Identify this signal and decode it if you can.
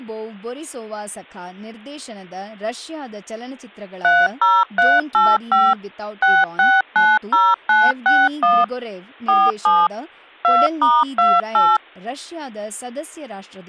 DTMF, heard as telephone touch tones, dialled by machine, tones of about 220 ms, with speech in Kannada. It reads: 30385 6690961 47 2*28